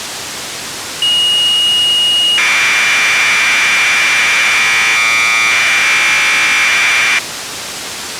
Commodore tape loading (standard loader), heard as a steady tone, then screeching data, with tape hiss.